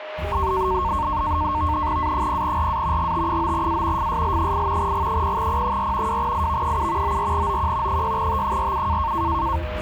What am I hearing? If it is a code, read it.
NAVTEX (SITOR-B), 100 baud, 170 Hz shift, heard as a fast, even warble, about 1000 Hz centre, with radio static, a steady whistle near 620 Hz and the noise inside a car. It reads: A0RA GT9A FSL8 G0P4 2IV7 94OQ 6T47